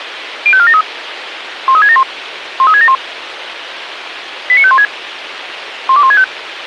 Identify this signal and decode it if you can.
Five-tone selective call (ZVEI), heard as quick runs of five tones, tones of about 70 ms, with radio hiss. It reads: 05473 13671 13671 89516 12165